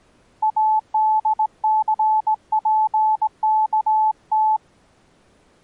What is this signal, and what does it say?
Morse code, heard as a keyed tone, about 18 wpm, 870 Hz. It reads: ADCPKT